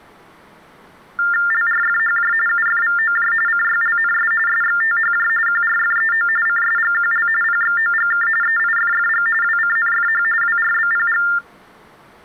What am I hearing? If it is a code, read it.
TTY/TDD text telephone tones (45.45 baud Baudot), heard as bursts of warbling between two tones, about 400 Hz shift, 1600 Hz centre. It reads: LRFHJ UFVOJ CYLNS SXTHJ QRFEO CSGQL PXOGK EIFFG WCNFH WRBPG